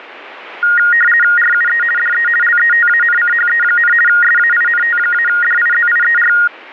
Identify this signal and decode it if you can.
RTTY (50 baud, 450 Hz shift), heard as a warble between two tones, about 1650 Hz centre. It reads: RUE DE LETANCHE, SAINT-DIZIER